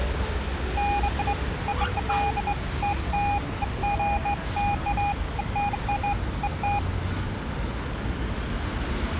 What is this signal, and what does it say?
Beeps of irregular length, with street noise. There is no code.